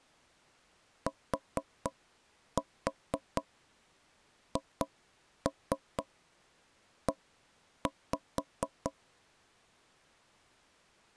Tap code, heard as knocks on wood, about 4 knocks a second. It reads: THE